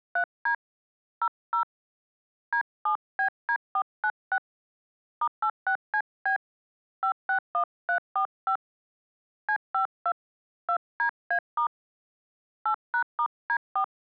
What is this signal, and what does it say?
DTMF, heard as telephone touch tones, dialled by hand, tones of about 80 ms. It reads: 3D 00 D7BD496 *86CB 561345 C52 2DA* 8#*D4